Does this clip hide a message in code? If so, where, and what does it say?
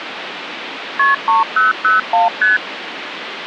Yes: multi-frequency trunk signalling (R1, as on North American trunks) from 1.0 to 2.6 s, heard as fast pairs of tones, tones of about 150 ms, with phone line noise. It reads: KP 3001 ST